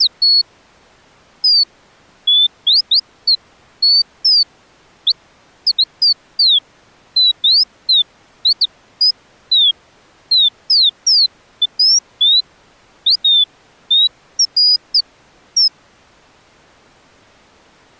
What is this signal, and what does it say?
Bird-like chirps. There is no code.